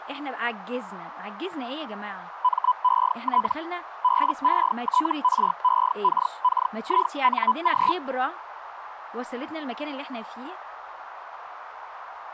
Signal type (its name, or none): Hellschreiber